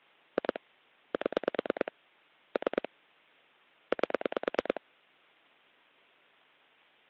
Pulse dialling, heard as clicks on a phone line, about 9 pulses a second. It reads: 2 7 3 8